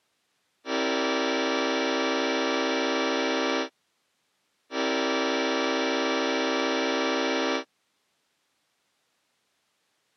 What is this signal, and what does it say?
Train horn signal, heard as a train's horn. 2 long. On North American railways: brakes released, proceed.